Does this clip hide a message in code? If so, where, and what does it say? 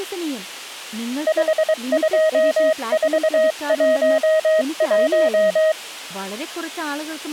Yes: Morse code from 1.2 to 5.8 s, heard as a keyed tone, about 23 wpm, 630 Hz, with speech in Malayalam. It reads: 52411